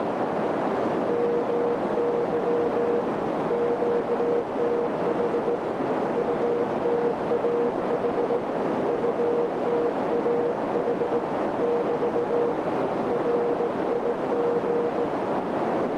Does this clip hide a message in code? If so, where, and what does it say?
Yes: Morse code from 1.0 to 15.1 s, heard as a keyed tone, hand-sent with a straight key, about 17 wpm, 480 Hz, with heavy radio static and a narrow filter. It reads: MY QTH UTAH UTAH <BT> RIG